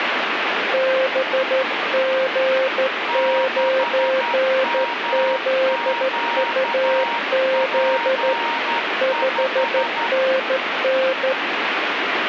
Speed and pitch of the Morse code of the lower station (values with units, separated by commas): 13 wpm, 530 Hz